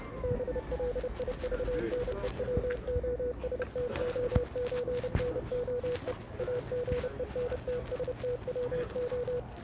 Morse code (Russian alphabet), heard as a keyed tone, machine-sent, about 30 wpm, 490 Hz, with the noise of a residential street. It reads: БЛИЖНЕВОСТОЧНОЕ АГЕНТСТВО